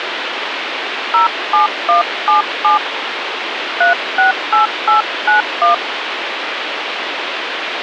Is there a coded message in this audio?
Yes: DTMF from 1.1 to 5.7 s, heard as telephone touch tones, dialled by hand, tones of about 130 ms, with phone line noise. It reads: 07177 368891